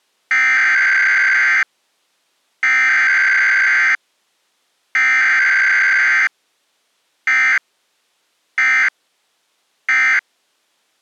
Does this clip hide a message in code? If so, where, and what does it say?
Yes: Emergency Alert System (SAME) tones (header bursts, then end-of-message bursts) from 0.3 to 10.2 s, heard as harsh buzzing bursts, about 520.83 baud.